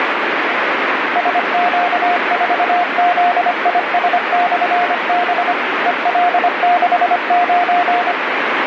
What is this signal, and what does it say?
Morse code, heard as a keyed tone, machine-sent, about 25 wpm, 710 Hz, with heavy radio static. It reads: SQ4ZIS/B EL69